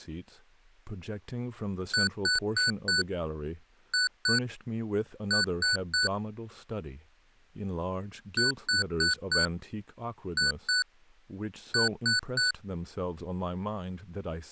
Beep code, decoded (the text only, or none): 4-2-3